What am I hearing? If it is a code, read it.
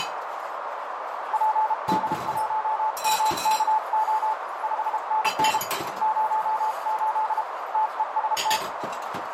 Morse code, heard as a keyed tone, hand-sent with a paddle, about 32 wpm, 870 Hz, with heavy radio static, a narrow filter and kitchen noise. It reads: PD1MKO 5NN 08 TEST